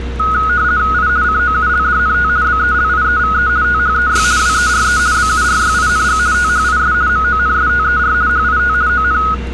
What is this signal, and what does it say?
RTTY (50 baud, 170 Hz shift), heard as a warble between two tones, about 1360 Hz centre, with street noise. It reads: I COULDNT BELIEVE THEY WERE BURYING THIS MONSTER HIT ON